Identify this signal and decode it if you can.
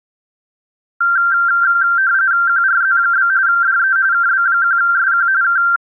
RTTY (45.45 baud, 170 Hz shift), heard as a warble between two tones, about 1470 Hz centre. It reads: QRZ? DE KB1SQ K